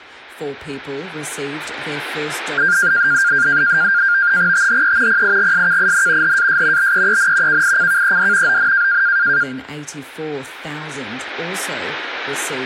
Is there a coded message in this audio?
Yes: NAVTEX (SITOR-B), 100 baud, 170 Hz shift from 2.6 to 9.4 s, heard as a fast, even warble, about 1500 Hz centre. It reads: THE PIGSKIN HAS BEEN KICKED ON